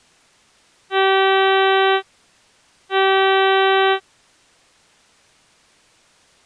Ship horn signal, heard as a ship's horn, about 390 Hz. 2 short. At sea: I am altering course to port.